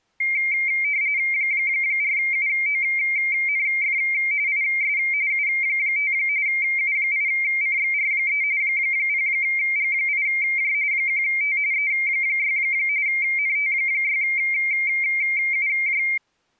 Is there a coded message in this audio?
Yes: RTTY (45.45 baud, 170 Hz shift) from 0.2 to 16.2 s, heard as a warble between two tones, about 2200 Hz centre. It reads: 4UONF IS U5 U8CXR3 0G8J 1T E6 NT6UJ